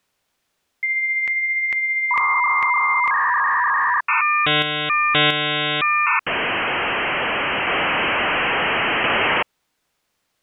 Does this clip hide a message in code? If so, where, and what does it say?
Yes: dial-up modem handshake (V.34 or later) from 0.8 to 9.4 s, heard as a whistle, warbles, then hiss.